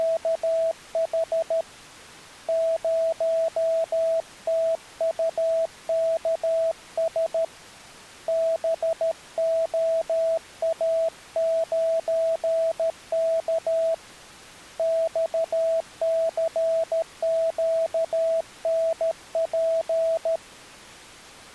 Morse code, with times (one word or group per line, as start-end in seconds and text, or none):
0.0-1.6 …
2.5-7.4 0TUKS
8.3-13.9 BOA9K
14.8-20.4 XCQNP